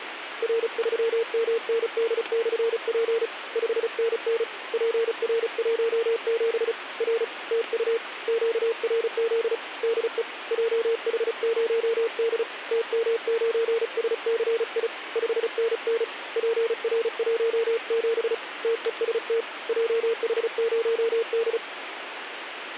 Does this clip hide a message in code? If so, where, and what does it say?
Yes: Morse code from 0.4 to 21.6 s, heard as a keyed tone, hand-sent with a paddle, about 35 wpm, 460 Hz, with radio static. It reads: R3MND/P 5NN PR17 R TU QRZ DE JH0D TM9SCI 5NN PR17 TEST JH0D